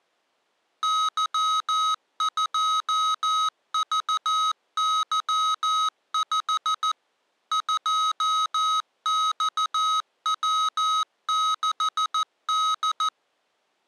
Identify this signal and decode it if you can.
Morse code, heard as electronic beeps, machine-sent, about 14 wpm, 1270 Hz. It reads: Y2VY5 2XW6D